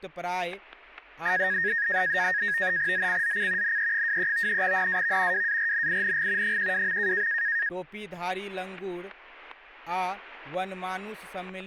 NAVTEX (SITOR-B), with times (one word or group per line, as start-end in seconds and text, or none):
2.9-3.8 ZCZC
3.6-4.6 NE23
4.6-5.5 NAV
5.3-6.6 WARNING
6.4-7.3 12.